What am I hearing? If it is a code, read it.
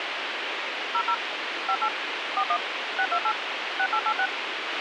DTMF, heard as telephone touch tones, dialled by machine, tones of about 70 ms, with radio hiss and a squelch burst at the end. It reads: 00 58 41 628 6886